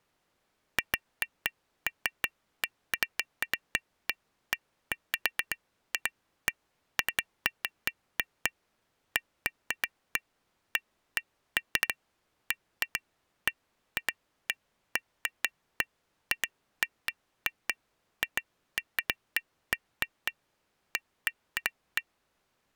Irregular taps on glass. There is no code.